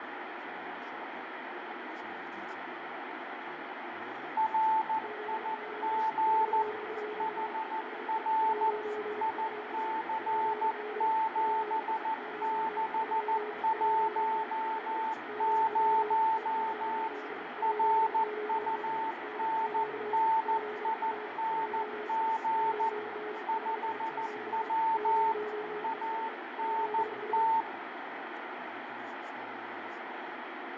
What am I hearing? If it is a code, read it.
Morse code, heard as two keyed tones, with heavy radio static, fading, room echo and speech in English. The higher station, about 14 wpm, 890 Hz: RIG HR IC7610 RUNNING 5W ANT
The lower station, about 34 wpm, 420 Hz: GZ 42 HE 1Q PD WE 23 16 MW E9 P9 NQ ZA JI OT 47 0B ZS